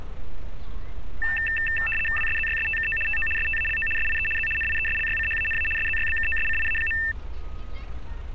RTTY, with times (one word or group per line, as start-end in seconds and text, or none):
2.2-3.0 WSZYSTKO
3.1-3.3 TO
3.4-3.9 STALO
4.0-4.3 SIE
4.4-4.5 Z
4.6-5.7 NIESLYCHANA
5.8-7.0 SZYBKOSCIA.